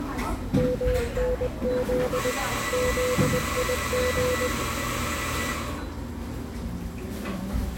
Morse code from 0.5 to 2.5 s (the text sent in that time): MNZ